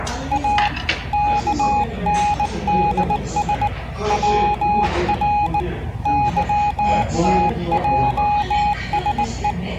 Morse code, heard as a keyed tone, hand-sent with a bug key, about 19 wpm, 830 Hz, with the noise of a restaurant. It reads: A KNDS WR YTJSE